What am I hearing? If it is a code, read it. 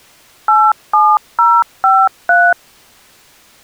DTMF, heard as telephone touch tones, dialled by machine, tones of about 240 ms. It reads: 87053